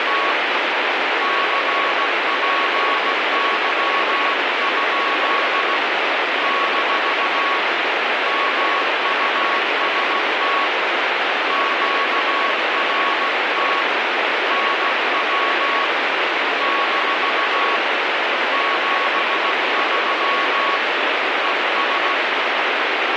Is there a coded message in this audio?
Yes: Morse code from 0.0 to 22.2 s, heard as a keyed tone, hand-sent with a paddle, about 16 wpm, 1110 Hz, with heavy radio static. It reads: … CPY? - MUST QRT NW - 73 ES